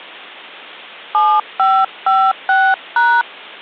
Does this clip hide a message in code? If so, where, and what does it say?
Yes: DTMF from 1.1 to 3.2 s, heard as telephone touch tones, dialled by hand, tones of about 250 ms. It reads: 7556#